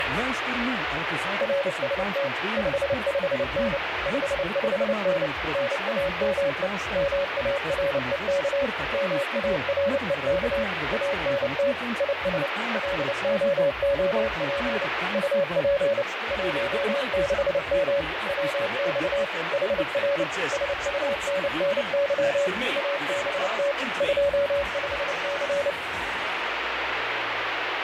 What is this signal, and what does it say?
Morse code, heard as a keyed tone, machine-sent, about 29 wpm, 560 Hz, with heavy radio static. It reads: RST 55N 55N NAME MAREK MAREK ANT IS LOOP UP 16M WX HR SUNNY ABT 25C